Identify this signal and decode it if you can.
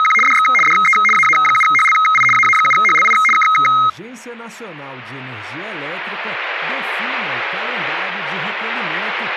RTTY (75 baud, 850 Hz shift), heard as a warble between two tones, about 1700 Hz centre. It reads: … DX DE AA7HLI AA7HLI K